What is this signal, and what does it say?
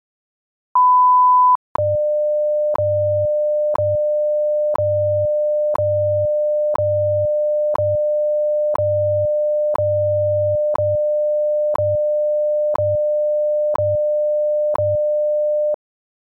Radio time signal (WWV, Colorado), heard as ticks, one a second.